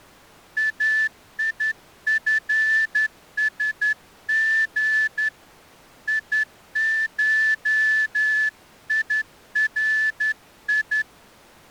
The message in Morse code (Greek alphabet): ΑΙΦΣΓ ΙΧΙΡΙ

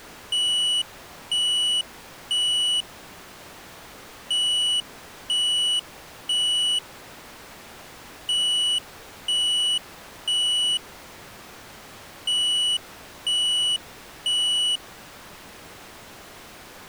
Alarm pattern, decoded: temporal three

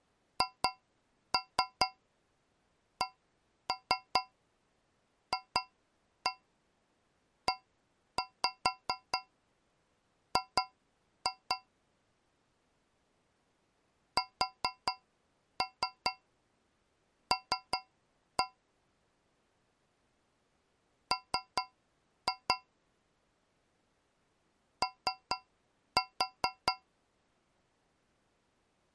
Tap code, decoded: HCFEG SL M O

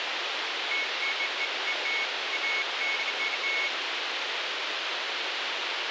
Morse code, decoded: none

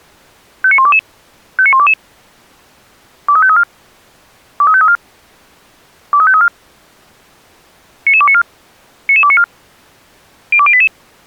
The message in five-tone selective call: 59122 59122 23534 23534 23534 99294 99294 02088

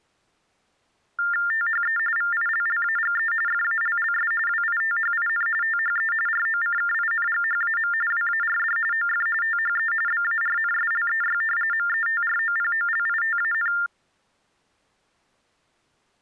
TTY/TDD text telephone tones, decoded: THE VILLAGE FALLS WITHIN THE ROCKINGHAM WARD OF THE BARNSLEY METROPOLITAN

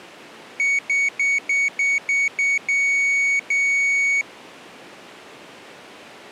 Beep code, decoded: 7 short, 2 long

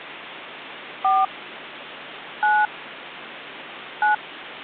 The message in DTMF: 4 9 9

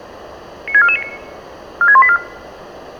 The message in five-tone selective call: 96449 46184

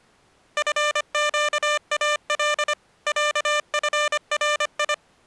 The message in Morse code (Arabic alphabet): فقال عفري

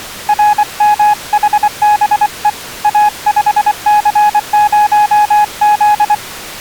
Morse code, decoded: RMHBE A5C0Z

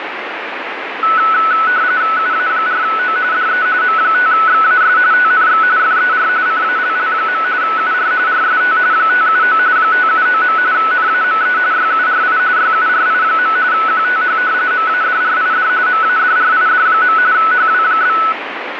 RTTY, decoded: UA4O DE M5XAS TNX FER CALL. UR RST 579 579. NAME YURI YURI. QTH MADRID MADRID. HW?

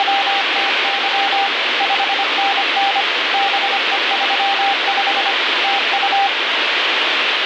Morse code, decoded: … 5NN BE35 TU

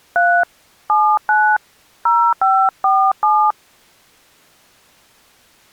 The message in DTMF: 3 79 0547

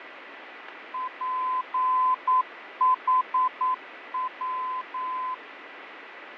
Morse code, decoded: PHW

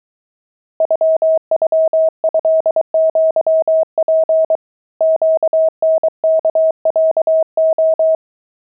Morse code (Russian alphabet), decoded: ЮЮЭЪП ЩНКЯО

